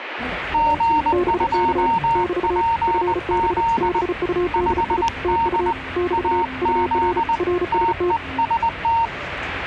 Morse code, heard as two keyed tones, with radio static and the noise inside a subway train. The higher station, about 20 wpm, 920 Hz: G2PZ 5D AZ TEST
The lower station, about 35 wpm, 360 Hz: BK <BT> FB BUDI TU <BT> UR RST